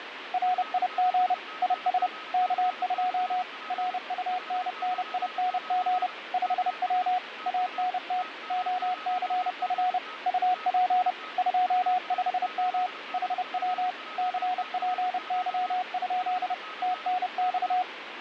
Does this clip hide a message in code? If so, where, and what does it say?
Yes: Morse code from 0.3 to 17.9 s, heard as a keyed tone, machine-sent, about 30 wpm, 730 Hz, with radio static and a weaker station near 1270 Hz. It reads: RIG IS K2 RUNNING 5W ANT OCF UP 25M HW CPY? TNX